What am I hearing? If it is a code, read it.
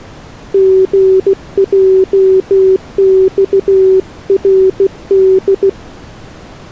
Morse code, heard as a keyed tone, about 16 wpm, 380 Hz. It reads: GJXRD